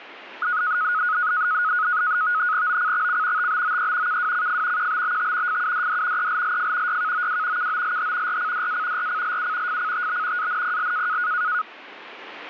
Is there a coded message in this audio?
Yes: NAVTEX (SITOR-B), 100 baud, 170 Hz shift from 0.4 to 11.6 s, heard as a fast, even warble, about 1360 Hz centre, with radio static. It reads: OCXC TBOE KWCF QBBT FUDD ELLF YKOW KOLH RCDA RCLU FCTB ANPL